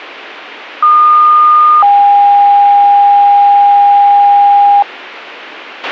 Two-tone page, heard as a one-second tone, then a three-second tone, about 1220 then 810 Hz, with a squelch burst at the end.